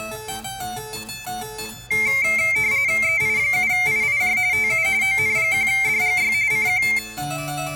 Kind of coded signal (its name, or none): RTTY